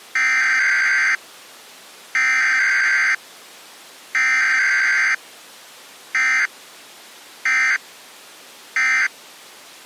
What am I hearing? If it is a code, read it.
Emergency Alert System (SAME) tones (header bursts, then end-of-message bursts), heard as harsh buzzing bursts, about 520.83 baud.